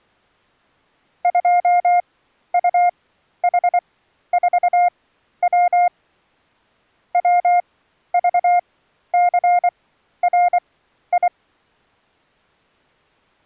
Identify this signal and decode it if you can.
Morse code, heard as a keyed tone, machine-sent, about 24 wpm, spaced as for 12 wpm, 710 Hz. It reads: 2UH4W WVCRI